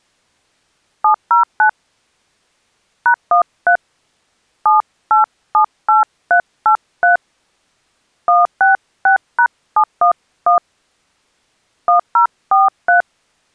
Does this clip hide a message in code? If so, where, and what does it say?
Yes: DTMF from 1.0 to 13.0 s, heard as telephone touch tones, dialled by hand, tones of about 120 ms. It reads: 709 #13 7878383 166#711 1043